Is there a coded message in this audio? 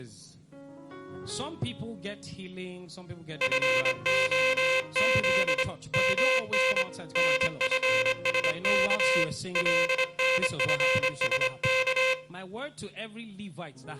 Yes: Morse code (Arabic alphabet) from 3.4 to 12.2 s, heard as a buzzer, hand-sent with a straight key, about 25 wpm, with room echo. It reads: فخذ من نفسك لنفسك